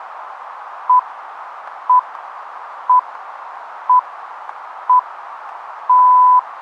Radio time signal (six pips, as the Greenwich Time Signal), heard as pips, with radio static.